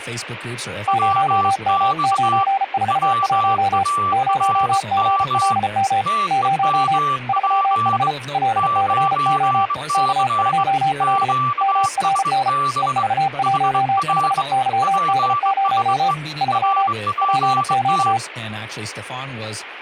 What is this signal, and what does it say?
Morse code, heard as two keyed tones, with speech in English. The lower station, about 34 wpm, 780 Hz: 0M941 0GLM 0 3H LCO K2L MRN EV15YD0 3 PQ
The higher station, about 22 wpm, 1160 Hz: WX WARM TEMP 9C QSB HR PSE RPT